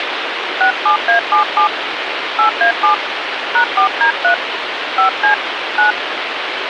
DTMF, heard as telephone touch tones, dialled by hand, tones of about 110 ms, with phone line noise. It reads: 67A77 8A7 #4D3 5C 9